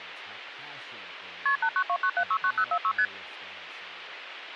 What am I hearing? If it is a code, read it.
Multi-frequency trunk signalling (R1, as on North American trunks), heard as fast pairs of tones, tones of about 70 ms, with phone line noise and speech in English. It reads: KP 8929769046 ST